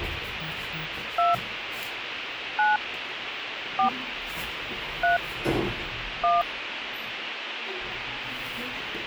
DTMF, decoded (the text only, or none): 2 9 4 3 1